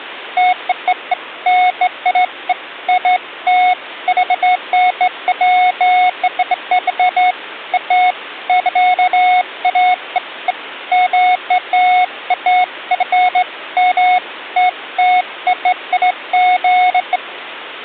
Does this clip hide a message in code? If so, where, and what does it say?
No, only beeps of irregular length.